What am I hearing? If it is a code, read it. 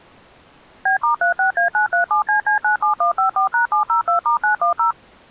DTMF, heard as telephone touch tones, dialled by machine, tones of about 110 ms. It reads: B*36A937CC97154#702*910